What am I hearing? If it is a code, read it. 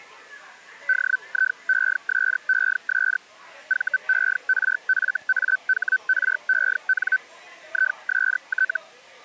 Hellschreiber (Feld-Hell, 122.5 baud), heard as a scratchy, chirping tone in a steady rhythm, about 1500 Hz, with the noise of a crowd indoors. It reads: DIESES VERFAHREN IST